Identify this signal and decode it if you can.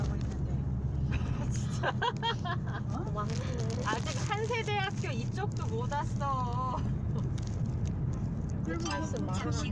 The noise inside a car. There is no code.